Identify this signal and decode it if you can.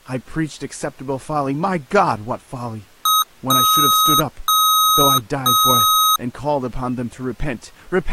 Beep code, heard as beeps from a small speaker, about 1270 Hz, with speech in English. 1 short, 3 long.